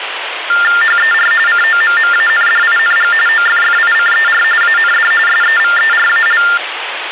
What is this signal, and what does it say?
TTY/TDD text telephone tones (45.45 baud Baudot), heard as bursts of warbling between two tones, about 400 Hz shift, 1600 Hz centre, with phone line noise. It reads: HER COMMANDING OFFICER AND SEVERAL